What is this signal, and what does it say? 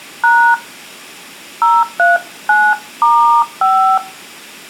DTMF, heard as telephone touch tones, dialled by hand, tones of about 280 ms, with room echo. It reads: # 039*5